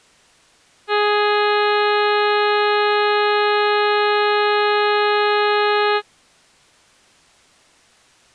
Ship horn signal, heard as a ship's horn, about 420 Hz. 1 long. At sea: a vessel nearing a blind bend, or under power and making way in fog.